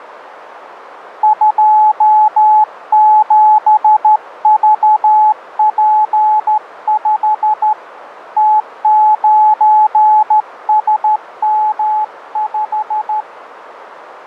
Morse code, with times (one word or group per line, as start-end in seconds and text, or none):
1.2-7.7 27VP5
8.4-13.2 T9SM5